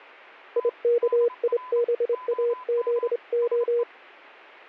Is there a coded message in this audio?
Yes: Morse code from 0.5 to 3.9 s, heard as a keyed tone, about 25 wpm, 480 Hz, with a weaker station near 1010 Hz. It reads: IKIBAZO